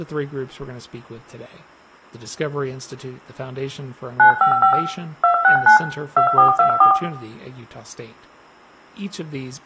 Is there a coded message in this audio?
Yes: DTMF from 4.2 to 6.9 s, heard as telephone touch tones, dialled by machine, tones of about 110 ms, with room echo and speech in English. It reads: 955 269 2424